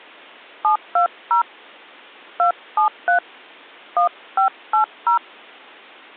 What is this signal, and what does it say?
DTMF, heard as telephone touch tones, dialled by hand, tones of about 110 ms. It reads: 720 273 1580